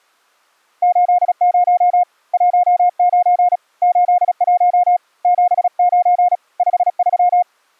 Morse code, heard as a keyed tone, hand-sent with a paddle, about 36 wpm, 710 Hz. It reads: 80 19 81 79 53